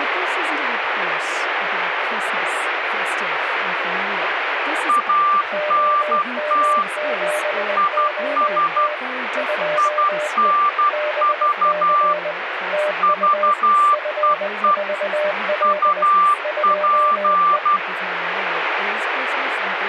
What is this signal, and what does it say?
Morse code, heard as two keyed tones, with radio static and speech in English. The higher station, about 12 wpm, 1180 Hz: ANT IS INV VEE UP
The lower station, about 20 wpm, 600 Hz: OM7OT 2E BC TU F4L 2E